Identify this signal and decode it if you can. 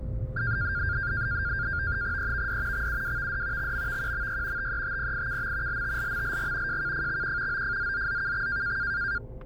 NAVTEX (SITOR-B), 100 baud, 170 Hz shift, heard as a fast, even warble, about 1500 Hz centre, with static crashes, a steady whistle near 520 Hz and the noise inside a car. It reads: EVD XUWVD XMVQMY TETPIKM LTLMLG JKFXQ OFZZZKX